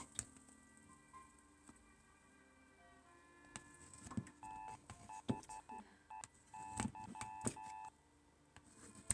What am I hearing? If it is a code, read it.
Morse code, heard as a keyed tone, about 12 wpm, 870 Hz, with kitchen noise. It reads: THEY